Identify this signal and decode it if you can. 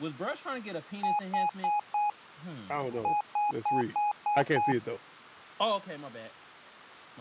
Beep code, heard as beeps, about 830 Hz, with speech in English. 4-6.